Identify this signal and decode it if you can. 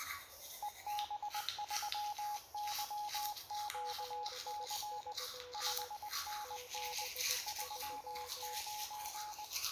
Morse code, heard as two keyed tones, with radio static and the noise of a restroom. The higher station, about 20 wpm, 840 Hz: EB3YQC 5NN 39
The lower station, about 17 wpm, 490 Hz: 73 73